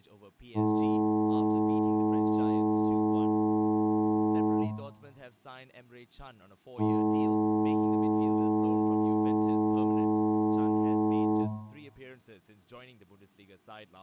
Ship horn signal, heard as a ship's horn, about 110 Hz, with room echo and speech in English. 2 long. At sea: a vessel under power that has stopped in fog.